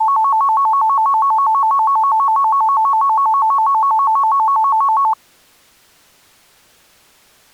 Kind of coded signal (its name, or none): none